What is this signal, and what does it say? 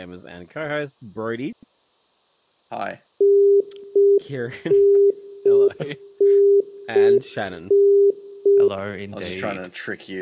Telephone call progress tone (UK plan), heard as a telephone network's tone, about 400 Hz, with room echo. Congestion tone.